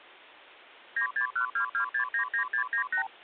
Multi-frequency trunk signalling (R2, with the far end's replies), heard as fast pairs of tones, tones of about 100 ms. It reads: 96122699698